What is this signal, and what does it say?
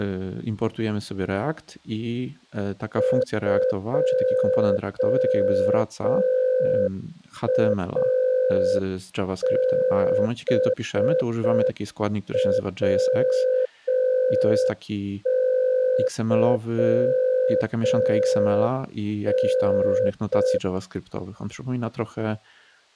Morse code, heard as a keyed tone, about 5 wpm, 510 Hz, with speech in Polish. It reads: 2ABWYN